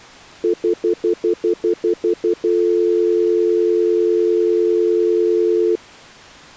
Telephone call progress tone (North American plan), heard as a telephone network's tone, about 350, 440 Hz, 0.1 s on and 0.1 s off. Stutter dial tone.